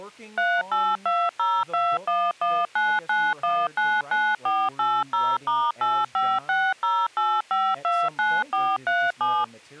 DTMF, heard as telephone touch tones, dialled by machine, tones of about 240 ms, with speech in English. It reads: 382021199199480*85608529437